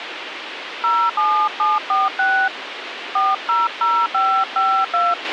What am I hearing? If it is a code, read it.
DTMF, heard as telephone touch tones, dialled by hand, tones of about 260 ms, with radio hiss and a squelch burst at the end. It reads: 07746 400552